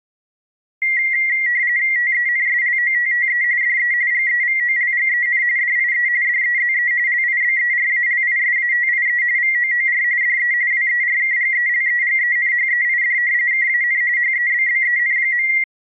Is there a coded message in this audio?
Yes: RTTY (45.45 baud, 170 Hz shift) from 0.8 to 15.6 s, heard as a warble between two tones, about 2000 Hz centre. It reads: TENSLOTTE DE GEVOLGEN DIE DEZE LIBERALISATIE VOOR DE WERKGELEGENHEID KAN HEBBEN.